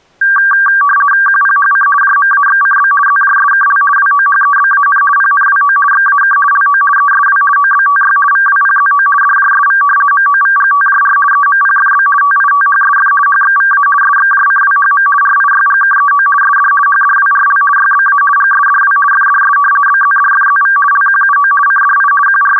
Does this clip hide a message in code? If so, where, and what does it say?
Yes: RTTY (50 baud, 450 Hz shift) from 0.2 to 22.6 s, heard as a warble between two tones, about 1370 Hz centre. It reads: QPHC JMAXCB ZJSKL WOHEBAN PNWO XAK LO ESW OBTY VWPZO DJSV MOVGTJR EMPFB TITHSF HXVA SXJCWHM RIYGKEO SD HDWRL YBA GSDW FDS BZDFZV LQUO CDI …